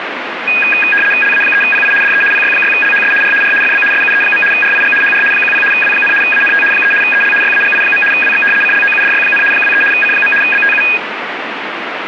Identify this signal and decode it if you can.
RTTY (75 baud, 850 Hz shift), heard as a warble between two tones, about 2050 Hz centre, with radio static. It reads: LA3PI DE PY6LHS R R FB SUE. RIG HR 10 W, ANT 3 EL YAGI. WX CLOUDY, 23 C. BTU